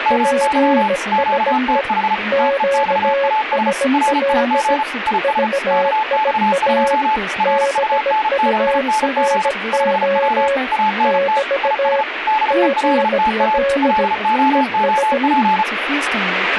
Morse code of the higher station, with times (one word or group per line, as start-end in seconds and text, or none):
0.1-0.9 MY
1.1-2.1 QTH
2.4-3.7 TEXAS
3.9-4.8 RIG
5.1-5.5 IS
5.7-7.2 KX2
7.4-9.5 RUNNING
9.7-10.5 5W
10.7-11.4 ANT
11.6-12.0 IS
12.3-13.6 DELTA
13.8-15.6 LOOP